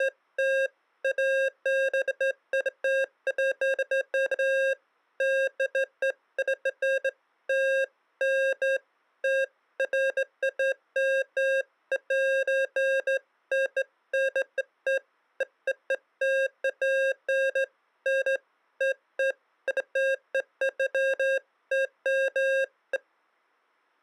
Beeps of irregular length. There is no code.